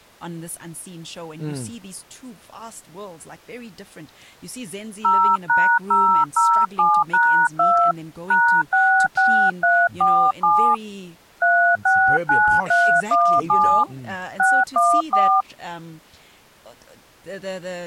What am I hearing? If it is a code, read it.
DTMF, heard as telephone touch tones, dialled by hand, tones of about 290 ms, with speech in English. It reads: 0#007#2 #66347 369317 614